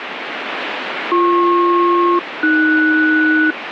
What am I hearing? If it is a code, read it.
Aircraft SELCAL, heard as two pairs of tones, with radio static. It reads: BP-AS